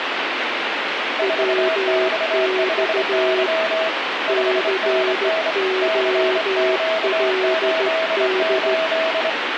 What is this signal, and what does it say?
Morse code, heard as two keyed tones, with radio static. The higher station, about 25 wpm, 650 Hz: 4X5Y 5NN CQ88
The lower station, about 14 wpm, 370 Hz: WX COLD